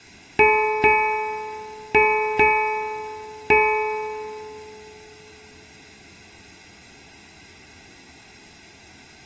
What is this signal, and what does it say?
Ship's bell, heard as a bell, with room echo. 5. Five half-hours of the watch have passed.